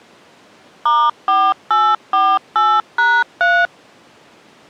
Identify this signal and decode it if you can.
DTMF, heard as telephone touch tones, dialled by machine, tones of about 240 ms. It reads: *4848#3